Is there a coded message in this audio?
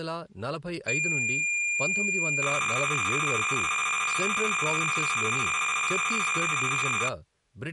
Yes: cassette data (Kansas City type), 300 baud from 0.9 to 7.1 s, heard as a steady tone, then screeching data, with speech in Telugu.